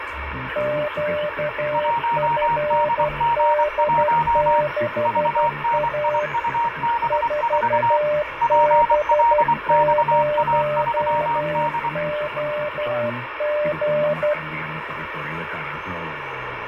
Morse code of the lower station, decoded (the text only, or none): QFD6A 4B0OG